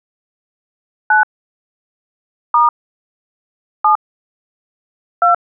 DTMF, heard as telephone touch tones, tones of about 140 ms. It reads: 9 * 7 2